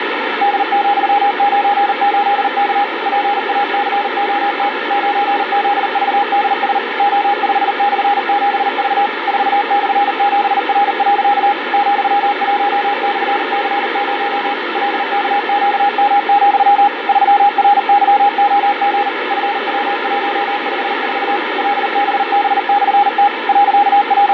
Morse code, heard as a keyed tone, machine-sent, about 39 wpm, 810 Hz, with heavy radio static. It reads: D,98K PACOT 9ZVDS O5/7V 4/7R. ,1/C0 LKQM, 3RYOG FW154 LBB/T …